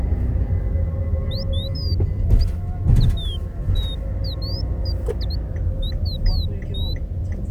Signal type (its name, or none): none